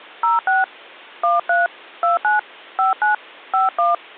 DTMF, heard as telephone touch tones, dialled by hand, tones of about 140 ms. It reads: 06 13 29 59 51